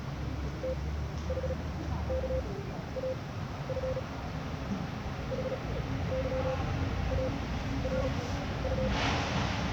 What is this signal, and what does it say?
Morse code, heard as a keyed tone, machine-sent, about 36 wpm, spaced as for 13 wpm, 520 Hz, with radio static and the noise of a residential street. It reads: THKAF HYARU